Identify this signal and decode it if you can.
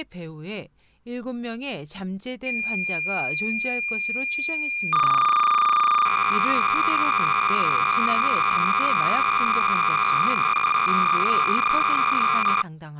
Cassette data (Kansas City type), 300 baud, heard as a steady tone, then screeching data, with speech in Korean.